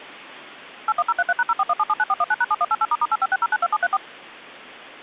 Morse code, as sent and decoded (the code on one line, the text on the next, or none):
none